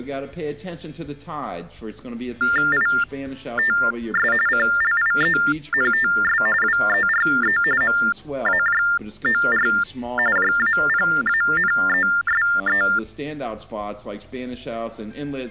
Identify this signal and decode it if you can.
TTY/TDD text telephone tones (45.45 baud Baudot), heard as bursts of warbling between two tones, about 400 Hz shift, 1600 Hz centre. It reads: ITS CLIENTS WERE MAJOR JAPANESE